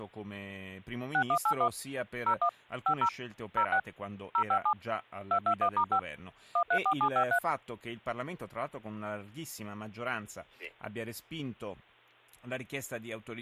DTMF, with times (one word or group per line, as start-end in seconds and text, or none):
1.1-1.7 6181
2.3-2.5 01
2.9-3.1 50
3.6-3.8 06
4.3-4.7 057
5.3-6.0 221*5
6.6-7.4 134753